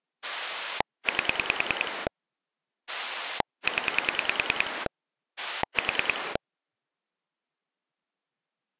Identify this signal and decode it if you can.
Pulse dialling, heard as a rotary dial, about 10 pulses a second. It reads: 8 0 4